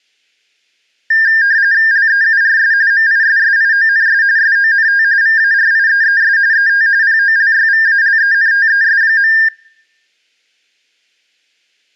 RTTY (45.45 baud, 170 Hz shift), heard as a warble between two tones, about 1700 Hz centre. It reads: LEURS MISSIONS SONT VARIEES ET POLYVALENTES.